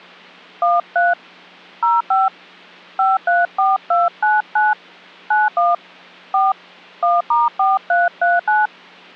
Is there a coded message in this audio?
Yes: DTMF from 0.6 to 8.7 s, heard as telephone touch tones, dialled by hand, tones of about 180 ms. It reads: 13 05 534299 91 4 1*4339